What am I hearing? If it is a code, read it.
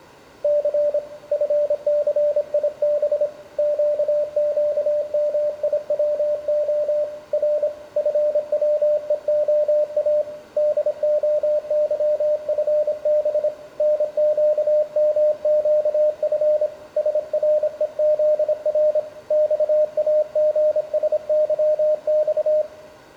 Morse code, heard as a keyed tone, hand-sent with a paddle, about 26 wpm, 600 Hz, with room echo. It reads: C FCIB QQMIWO R FWEOA DOYFB NQMQF SREZR XAGSYX